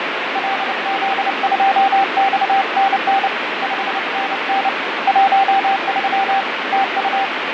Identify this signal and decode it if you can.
Morse code, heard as a keyed tone, hand-sent with a paddle, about 29 wpm, 780 Hz, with heavy radio static and fading. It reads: LZ2XNN 5NN 13 TU